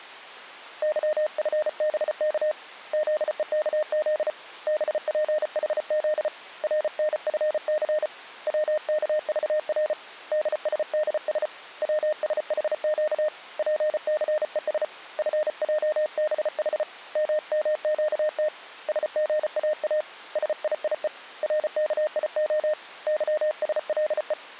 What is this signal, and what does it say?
Morse code, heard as a keyed tone, hand-sent with a paddle, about 34 wpm, 610 Hz. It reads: YFBK ZEKZ BPHZ RNFC WKVR DSDS WSHQ PCES FJBH MMQT SGAA SIIE RKIO YSLE